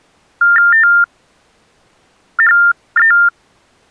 TTY/TDD text telephone tones (45.45 baud Baudot), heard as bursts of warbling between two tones, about 400 Hz shift, 1600 Hz centre. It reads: THE